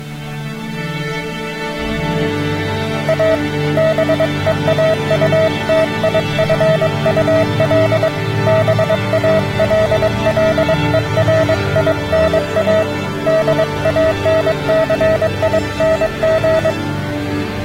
Morse code, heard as a keyed tone, hand-sent with a paddle, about 22 wpm, 640 Hz. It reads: A BEAUTIFUL BALLERINA DANCING